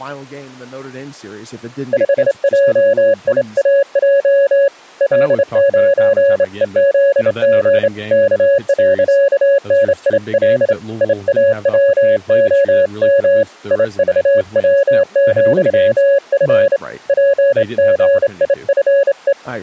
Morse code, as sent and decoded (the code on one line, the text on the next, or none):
..... .--- .. .- .--- / .-.. ----. . --.. --. / -.- .-.-.- -. .. .-.. / .. .- .-- --- -- / .. ...- .-- --..-- ..-. / .--. --. .. ..-. .
5JIAJ L9EZG K.NIL IAWOM IVW,F PGIFE